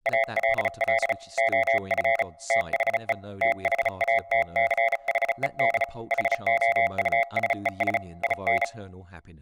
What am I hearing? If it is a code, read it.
Morse code, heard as a keyed tone, hand-sent with a paddle, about 35 wpm, 680 Hz, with room echo and speech in English. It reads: ALL OF THE THATCHED HOUSES IN